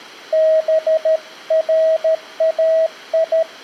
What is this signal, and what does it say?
Morse code (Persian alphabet), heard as a keyed tone, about 13 wpm, 640 Hz. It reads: برای